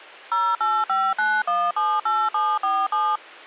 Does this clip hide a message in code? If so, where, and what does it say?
Yes: DTMF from 0.3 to 3.2 s, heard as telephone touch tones, dialled by machine, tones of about 240 ms. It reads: 0859178747